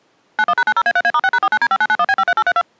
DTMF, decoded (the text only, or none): 91#90A3A*6#49D5991B53832